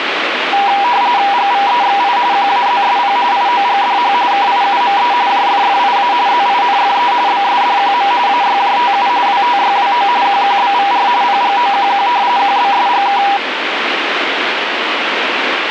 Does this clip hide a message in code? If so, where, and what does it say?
Yes: RTTY (45.45 baud, 170 Hz shift) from 0.5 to 13.4 s, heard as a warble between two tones, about 880 Hz centre, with radio static. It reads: GVEXI QAZSP IOGDH KIUME JFFIA ZINFE BSDQM AYJTU WTYWO QQBVR PGOQQ QBSGK